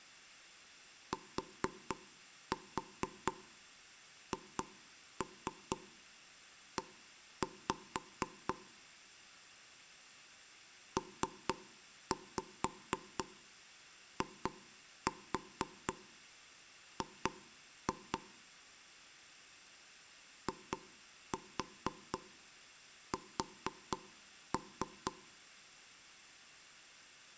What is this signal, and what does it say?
Tap code, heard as taps on a table, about 4 knocks a second, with room echo. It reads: THE PIG IS